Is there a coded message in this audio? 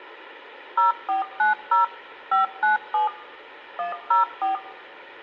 Yes: DTMF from 0.8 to 4.6 s, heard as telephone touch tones, dialled by machine, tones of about 140 ms. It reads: 0490 597 104